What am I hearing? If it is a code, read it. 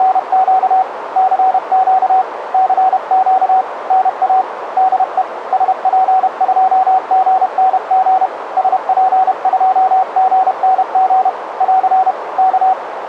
Morse code, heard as a keyed tone, hand-sent with a paddle, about 31 wpm, 760 Hz, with radio static and a narrow filter. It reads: … CQ CQ NA DE SP2GNG SP2GNG <AR> K